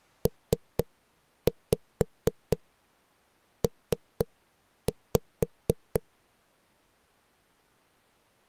Tap code, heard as knocks on a wall, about 4 knocks a second. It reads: PP